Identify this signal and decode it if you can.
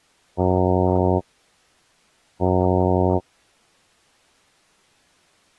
Ship horn signal, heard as a ship's horn, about 90 Hz. 2 short. At sea: I am altering course to port.